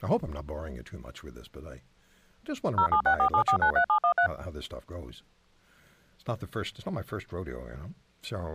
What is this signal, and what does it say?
DTMF, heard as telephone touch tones, dialled by machine, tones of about 90 ms, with speech in English. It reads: 07647493713